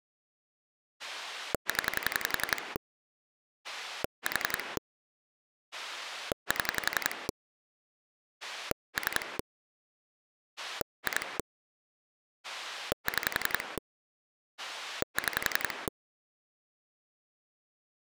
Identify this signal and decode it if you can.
Pulse dialling, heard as a rotary dial, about 11 pulses a second. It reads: 0 4 7 3 2 6 6